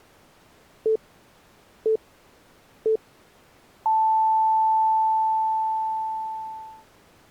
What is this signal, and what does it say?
Radio time signal (three low pips and a long one an octave up, as on NHK), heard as pips.